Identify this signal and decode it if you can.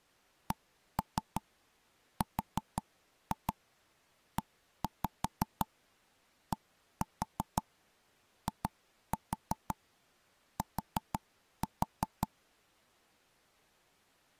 Tap code, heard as knocks on wood, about 5 knocks a second. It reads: CREDIT